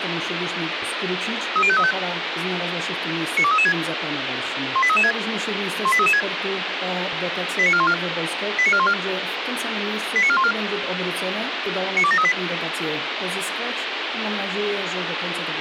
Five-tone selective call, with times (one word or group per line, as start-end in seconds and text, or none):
1.6-1.9 30535
3.4-3.7 92336
4.8-5.1 18336
5.9-6.2 18336
7.6-7.9 89414
8.6-8.9 89414
10.2-10.5 89414
12.0-12.3 92738